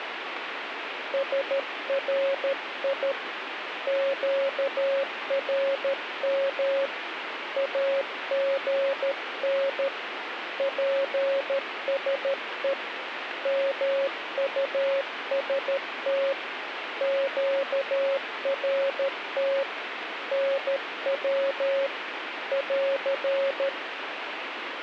Morse code, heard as a keyed tone, hand-sent with a paddle, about 13 wpm, 550 Hz, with radio static. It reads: SRI QRM AGN PSE MUST QRT NW <AR>